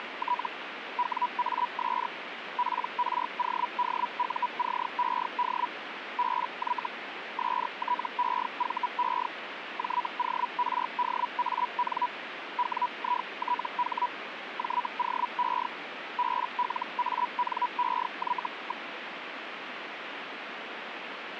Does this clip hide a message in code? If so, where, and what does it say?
Yes: Hellschreiber (Feld-Hell, 122.5 baud) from 0.0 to 18.9 s, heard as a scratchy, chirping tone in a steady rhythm, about 980 Hz, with radio static. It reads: … WAS PRODUCED BY STEVE JORDAN WITH JOE BLANEY.